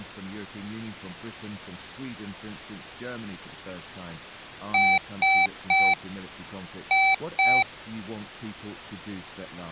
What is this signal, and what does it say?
Beep code, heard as beeps from a small speaker, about 770 Hz, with speech in English. 3-2.